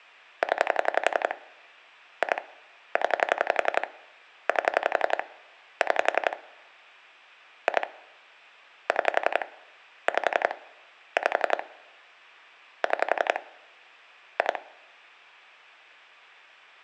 Pulse dialling, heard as clicks on a phone line, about 11 pulses a second. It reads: 0 2 0 8 6 2 6 5 5 6 2